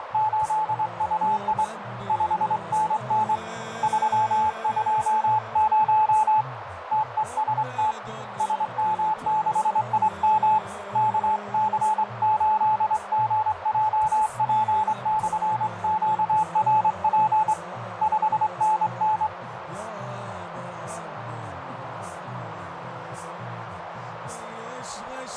Morse code, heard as a keyed tone, hand-sent with a straight key, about 24 wpm, 860 Hz, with radio static and a narrow filter. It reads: … 5NN 320 TEST SM6IM KC8GJP/QRP 5NN